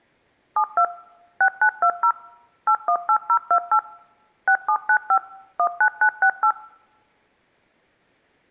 DTMF, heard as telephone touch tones, dialled by machine, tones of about 80 ms. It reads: 72 6920 818028 6795 19968